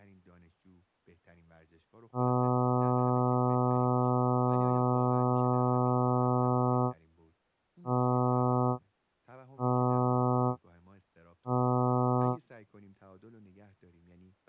Ship horn signal, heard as a ship's horn, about 120 Hz, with speech in Persian. 1 long, 3 short. At sea: a vessel under tow in fog.